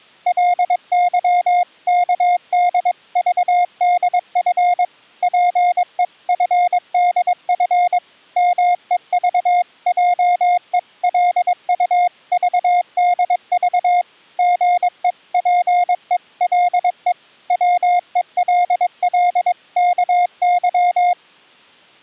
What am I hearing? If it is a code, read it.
Morse code (Korean alphabet), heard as a keyed tone, machine-sent, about 22 wpm, 710 Hz. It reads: 게으른 자는 말하기를 사자가 밖에